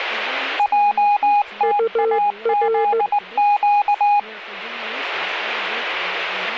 Morse code, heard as two keyed tones, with speech in English. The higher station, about 19 wpm, 820 Hz: JTAZQ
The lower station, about 15 wpm, 450 Hz: UR